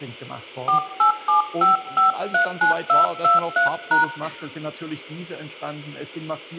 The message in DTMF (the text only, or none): 4875539223#